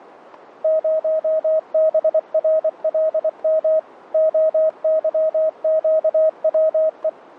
Morse code, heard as a keyed tone, machine-sent, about 24 wpm, 630 Hz. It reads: 0BRLM OYQWE